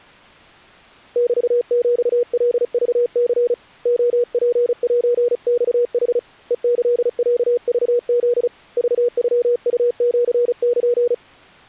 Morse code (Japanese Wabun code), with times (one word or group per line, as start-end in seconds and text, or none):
1.2-3.5 メヒカクニ
3.9-6.2 レツセマヌ
6.5-8.5 ヘキロクフ
8.8-11.1 クノウシル